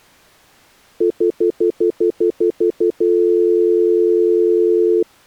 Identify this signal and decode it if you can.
Telephone call progress tone (North American plan), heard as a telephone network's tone, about 350, 440 Hz, 0.1 s on and 0.1 s off. Stutter dial tone.